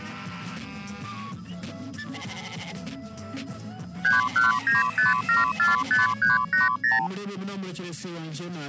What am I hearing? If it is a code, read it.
Multi-frequency trunk signalling (R2, with the far end's replies), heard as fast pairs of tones, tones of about 160 ms. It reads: 3195745380